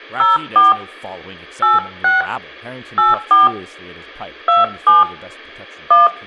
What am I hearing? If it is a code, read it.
DTMF, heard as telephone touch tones, dialled by hand, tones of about 160 ms, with room echo and speech in English. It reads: 04 86 84 27 1